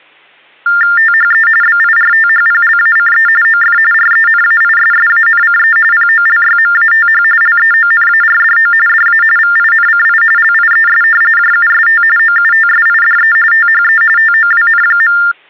TTY/TDD text telephone tones (45.45 baud Baudot), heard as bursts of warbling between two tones, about 400 Hz shift, 1600 Hz centre. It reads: THE BIRTHPLACE OF RENAISSANCE POLYMATH LEONARDO DA VINCI LIES JUST OUTSIDE THE TOWN.